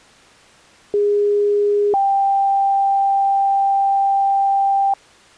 Two-tone page, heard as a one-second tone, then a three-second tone, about 410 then 790 Hz.